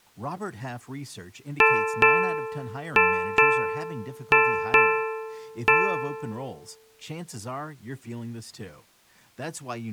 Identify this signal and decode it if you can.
Ship's bell, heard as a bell, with speech in English. 7. Seven half-hours of the watch have passed.